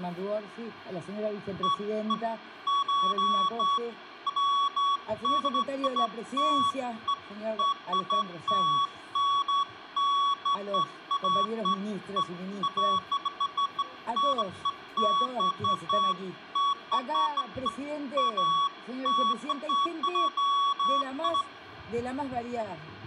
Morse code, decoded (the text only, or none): none